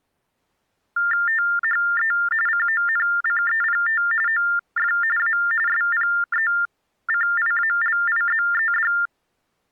TTY/TDD text telephone tones (45.45 baud Baudot), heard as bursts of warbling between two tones, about 400 Hz shift, 1600 Hz centre. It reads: THE CONCEPT OF A SPECIALIZED